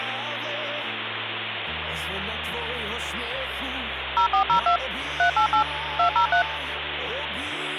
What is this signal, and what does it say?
DTMF, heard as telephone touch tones, dialled by machine, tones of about 100 ms, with phone line noise. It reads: 0402 388 203